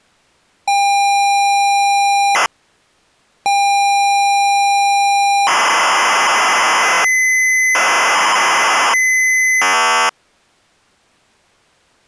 ZX Spectrum tape loading, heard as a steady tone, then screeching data.